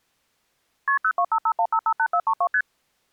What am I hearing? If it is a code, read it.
Multi-frequency trunk signalling (R1, as on North American trunks), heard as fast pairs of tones, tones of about 70 ms. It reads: KP 02551558432 ST